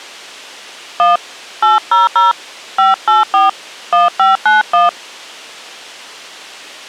DTMF, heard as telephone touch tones, dialled by hand, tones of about 160 ms. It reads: 1 800 584 1591